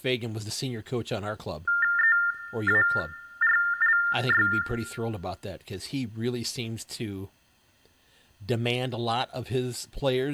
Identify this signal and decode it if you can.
TTY/TDD text telephone tones (45.45 baud Baudot), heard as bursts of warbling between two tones, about 400 Hz shift, 1600 Hz centre, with room echo and speech in English. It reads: EARLY